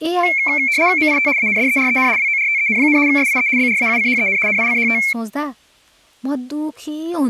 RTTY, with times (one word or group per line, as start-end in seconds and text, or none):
1.0-1.3 MIT
1.4-2.1 ANDEREN
2.2-3.0 WORTEN,
3.1-3.5 SIE
3.6-4.4 BRAUCHEN
4.5-5.0 NICHT